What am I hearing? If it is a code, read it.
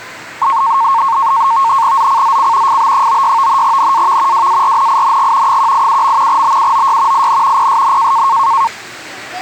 NAVTEX (SITOR-B), 100 baud, 170 Hz shift, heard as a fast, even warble, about 1000 Hz centre, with static crashes and the noise of a park. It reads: ZCZC FB96 NAV WARNING 187. BUOY IN PSN